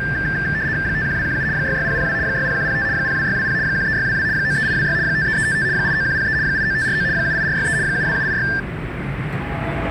RTTY (75 baud, 170 Hz shift), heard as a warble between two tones, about 1700 Hz centre, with radio static and the noise inside a subway train. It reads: 51217 66002 60105 02620 13622 93826 53355 89103 89549 78463 72786